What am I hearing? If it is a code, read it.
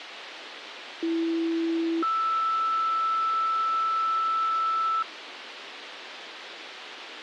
Two-tone page, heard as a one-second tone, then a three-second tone, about 330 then 1320 Hz, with radio hiss.